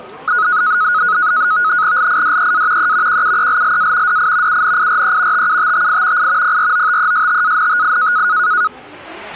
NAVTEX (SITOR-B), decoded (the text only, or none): LIDEA E QUELLA DI UNIRE TUTTI I PROTESTANTI